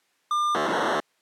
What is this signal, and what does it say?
POCSAG pager data (2400 baud), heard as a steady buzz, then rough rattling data.